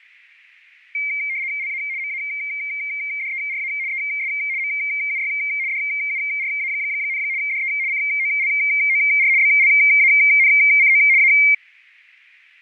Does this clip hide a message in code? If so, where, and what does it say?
Yes: RTTY (75 baud, 170 Hz shift) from 0.9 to 11.5 s, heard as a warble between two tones, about 2200 Hz centre, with fading. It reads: LA MADERA ES MUY DURA, DE COLOR BLANCO A